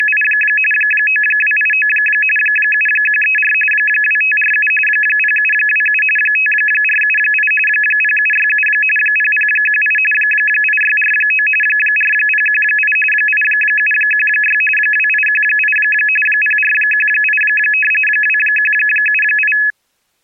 RTTY (45.45 baud, 850 Hz shift), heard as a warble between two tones, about 2150 Hz centre. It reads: … 9289 7134 2547 0727 5478 0767 0018 8649 4018 8716 2818 0418 2178